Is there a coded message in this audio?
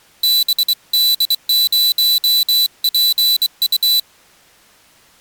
Yes: Morse code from 0.2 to 4.1 s, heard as a high beeper, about 23 wpm, 4000 Hz. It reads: BD0PU